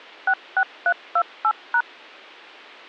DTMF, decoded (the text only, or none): 66328#